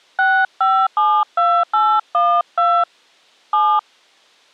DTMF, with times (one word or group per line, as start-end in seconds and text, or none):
0.2-2.8 6572812
3.5-3.8 7